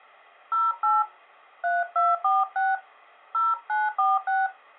DTMF, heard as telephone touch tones, dialled by hand, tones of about 190 ms. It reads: 08 3246 0946